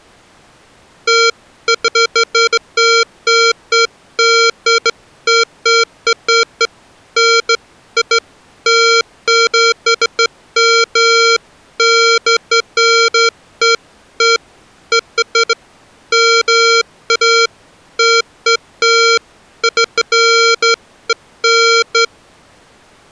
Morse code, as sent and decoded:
none

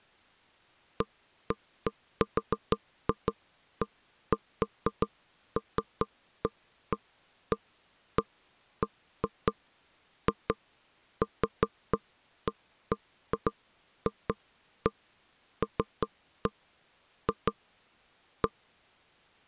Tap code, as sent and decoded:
none

